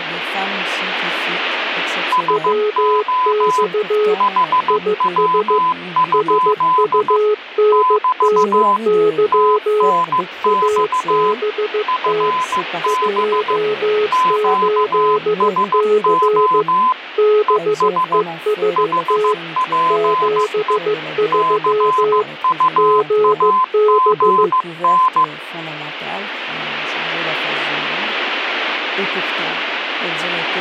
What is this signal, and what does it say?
Morse code, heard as two keyed tones, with radio static. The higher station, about 15 wpm, 1020 Hz: SO HW? <BT> TNX FB QSO ES HPE CUAGN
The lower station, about 15 wpm, 420 Hz: WX IS SUNNY ABT 28C BEST 73 GB